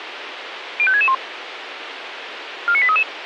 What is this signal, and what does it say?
Five-tone selective call (ZVEI), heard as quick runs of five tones, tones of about 70 ms, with radio hiss. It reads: 05661 49833